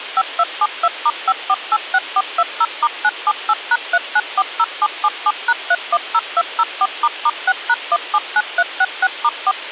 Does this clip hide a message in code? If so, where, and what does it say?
Yes: DTMF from 0.2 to 9.5 s, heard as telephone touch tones, dialled by machine, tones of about 50 ms, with phone line noise. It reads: 5272*5486420*978#3940777#310204**6#179366*4